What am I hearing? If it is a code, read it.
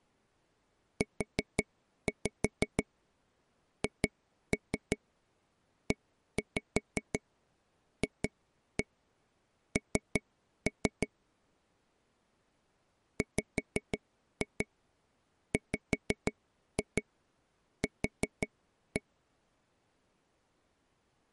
Tap code, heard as taps on a table, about 5 knocks a second. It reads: UHEFN WWQ